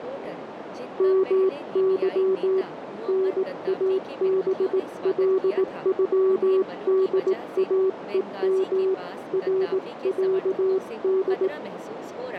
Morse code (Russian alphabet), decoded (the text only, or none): МЫ НАБЛЮДАЕМ РЯД